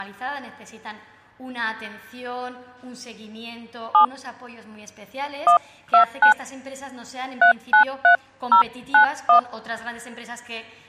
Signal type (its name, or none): DTMF